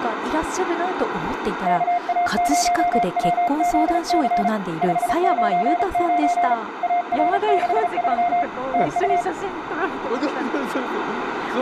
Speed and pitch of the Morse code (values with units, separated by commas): 35 wpm, 700 Hz